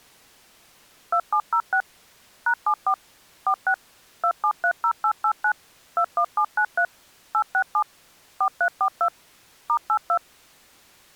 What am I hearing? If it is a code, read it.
DTMF, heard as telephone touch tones, dialled by machine, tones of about 80 ms. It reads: 2706 #74 46 2730889 21793 867 4342 *82